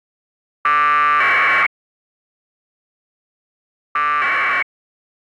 Packet radio (AX.25, as in APRS), 1200 baud, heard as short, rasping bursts.